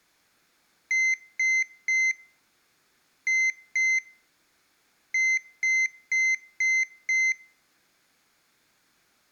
Beep code, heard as a piezo beeper, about 2050 Hz. 3-2-5.